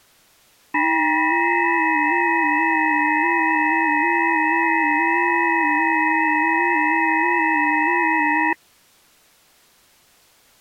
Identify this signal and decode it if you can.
FT8 (several signals at once), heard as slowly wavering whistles, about 6.25 baud.